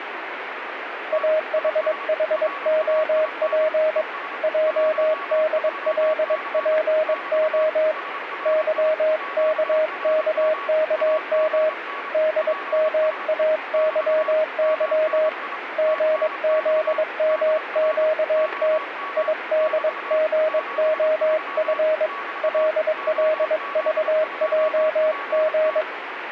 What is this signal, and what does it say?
Morse code, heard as a keyed tone, hand-sent with a paddle, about 22 wpm, 620 Hz, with radio static and a weaker station near 1130 Hz. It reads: AHHOP JDLPO YKKKM DMAYY GZMQT IDGOF LLVJG